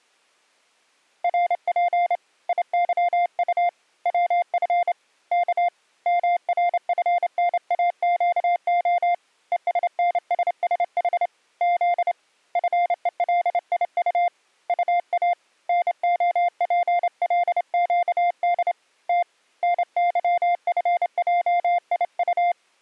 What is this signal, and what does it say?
Morse code, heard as a keyed tone, hand-sent with a straight key, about 28 wpm, 700 Hz. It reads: RP IYU WF K MRFNAQO ESNSSH Z FELIU UA NOPLQD T NYFJIU